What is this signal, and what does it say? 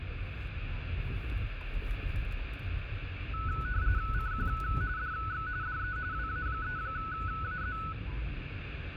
RTTY (45.45 baud, 170 Hz shift), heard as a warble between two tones, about 1390 Hz centre, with radio static and the noise inside a car. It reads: CQ DX DE WA3AZ